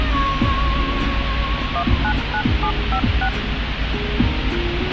DTMF, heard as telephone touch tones, dialled by machine, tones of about 80 ms, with radio hiss, a squelch burst at the end and the noise inside a car. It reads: 199756